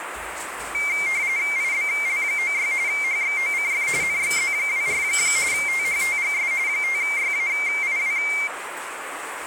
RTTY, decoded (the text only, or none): IBL96 HXOCF NXZ24 THTGS 5YAIW